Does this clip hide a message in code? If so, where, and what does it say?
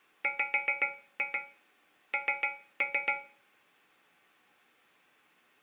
Yes: tap code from 0.2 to 3.4 s, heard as taps on a metal pipe, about 7 knocks a second. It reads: WN